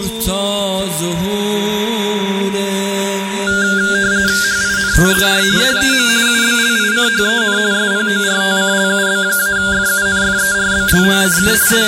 RTTY (45.45 baud, 170 Hz shift), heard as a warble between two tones, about 1500 Hz centre, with static crashes and a steady whistle near 960 Hz. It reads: HINTER DEM UBLICHEN SPORTCLUB-FUNFERBLOCK …